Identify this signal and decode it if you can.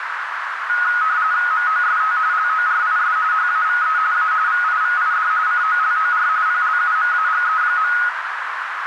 RTTY (45.45 baud, 170 Hz shift), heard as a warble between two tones, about 1360 Hz centre, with radio static and a narrow filter. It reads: MOST LORIS HAVE A VIVID COLOR PLUMAGE.